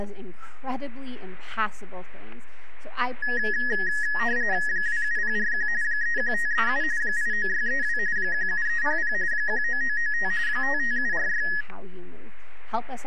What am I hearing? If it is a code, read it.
RTTY (45.45 baud, 170 Hz shift), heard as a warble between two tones, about 1800 Hz centre, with static crashes. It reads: 27041 31537 89632 17300 19995 55746